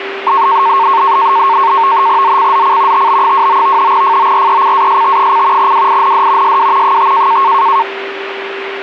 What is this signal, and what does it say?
NAVTEX (SITOR-B), 100 baud, 170 Hz shift, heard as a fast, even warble, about 1000 Hz centre, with radio static and a steady whistle near 390 Hz. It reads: ZCZC TB29 FORECAST: WIND SW 5